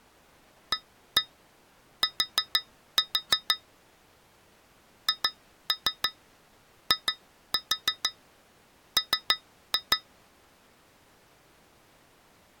Tap code, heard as taps on glass, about 6 knocks a second. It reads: AT HIM